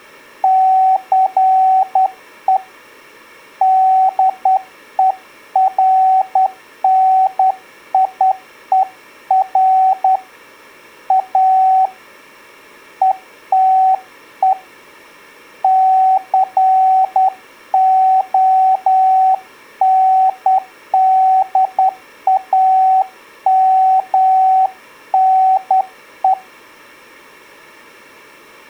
Morse code, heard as a keyed tone, hand-sent with a straight key, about 10 wpm, 760 Hz. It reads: CE DERNIER A ETE CONDAMNE